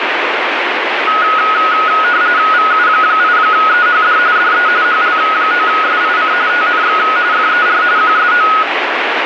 RTTY (45.45 baud, 170 Hz shift), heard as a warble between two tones, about 1360 Hz centre, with radio static. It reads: VU8EHD DE HL9SIC TNX FER QSO